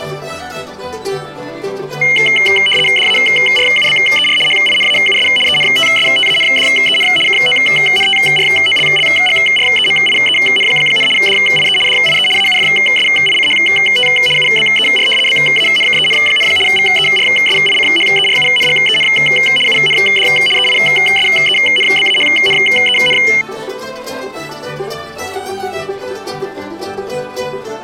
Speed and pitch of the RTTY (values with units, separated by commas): 75 baud, 850 Hz shift, 2550 Hz centre